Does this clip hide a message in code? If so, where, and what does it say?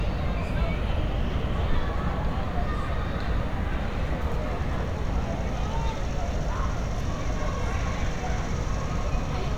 No, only street noise.